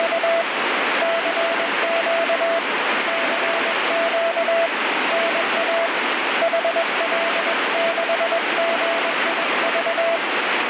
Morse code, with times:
0.0-0.4 …
1.0-2.6 CQ
3.1-4.7 CQ
5.1-5.9 NA
6.4-10.2 HL6GIV

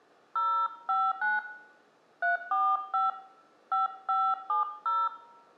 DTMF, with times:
0.4-1.4 059
2.2-3.1 345
3.7-5.1 5570

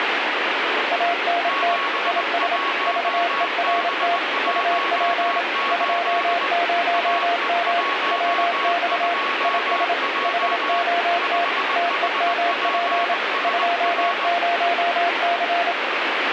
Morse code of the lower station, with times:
0.9-1.8 ANT
2.1-2.6 IS
2.9-4.2 VERT
4.5-5.4 UP
5.7-7.8 20M
8.1-9.1 WX
9.4-9.9 IS
10.2-11.4 HOT
11.8-13.1 TEMP
13.4-15.7 20C

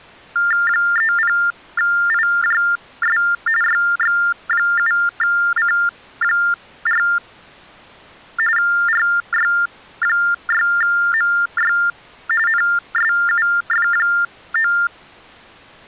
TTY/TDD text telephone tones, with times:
0.7-3.2 30IJS
3.6-7.0 YX7C4
8.6-11.7 RY6MY
12.5-14.7 NSUF9

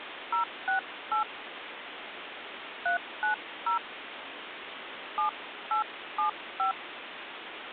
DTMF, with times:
0.3-1.2 068
2.9-3.8 390
5.2-6.7 7875

